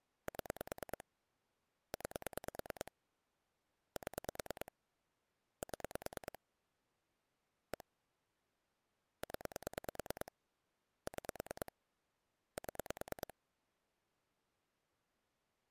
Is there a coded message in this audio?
Yes: pulse dialling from 0.3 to 13.3 s, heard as clicks on a phone line, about 9 pulses a second. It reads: 7 9 7 7 1 0 6 7